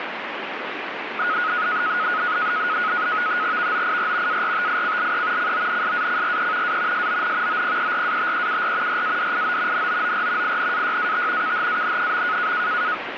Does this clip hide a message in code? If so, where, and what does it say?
Yes: NAVTEX (SITOR-B), 100 baud, 170 Hz shift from 1.2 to 12.9 s, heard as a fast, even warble, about 1360 Hz centre, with radio static. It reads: VOIR ARTICLE CONSACRE A SON OPERATEUR RADIO NOOR INAYAT KHAN.